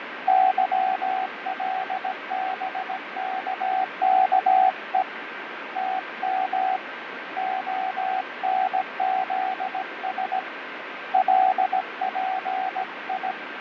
Morse code, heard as a keyed tone, hand-sent with a paddle, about 17 wpm, 760 Hz, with radio static and fading. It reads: YLBKKE TM ONZS LPI